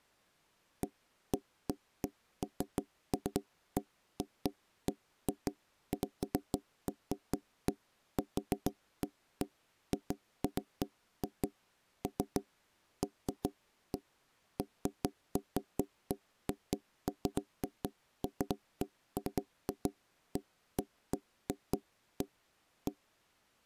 Irregular knocks on wood. There is no code.